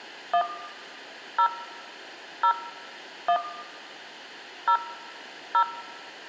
DTMF, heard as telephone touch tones, dialled by hand, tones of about 80 ms, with room echo. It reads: 1 0 0 1 0 0